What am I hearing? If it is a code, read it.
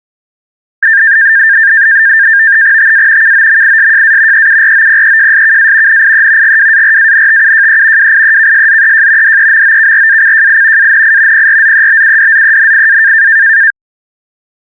NAVTEX (SITOR-B), 100 baud, 170 Hz shift, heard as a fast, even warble, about 1700 Hz centre. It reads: TA KOMISJA EUROPEJSKA NIE GWARANTUJE WIEKSZEJ DEMOKRACJI ANI PRZEBUDZENIA